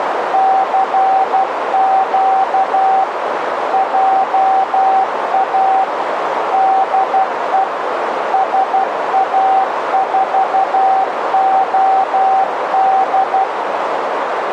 Morse code, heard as a keyed tone, machine-sent, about 12 wpm, 770 Hz, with radio static and a narrow filter. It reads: CQ JA DE SA4OD